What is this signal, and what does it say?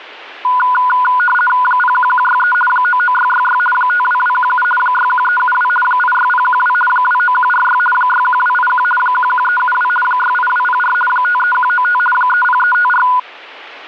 RTTY (50 baud, 450 Hz shift), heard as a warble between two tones, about 1220 Hz centre. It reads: 01163 99666 52217 61372 86012 29146 61281 11372 68204 53195 30354